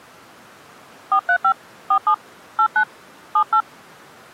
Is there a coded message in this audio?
Yes: DTMF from 1.1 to 3.6 s, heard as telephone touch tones, dialled by hand, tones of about 80 ms. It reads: 435 47 89 78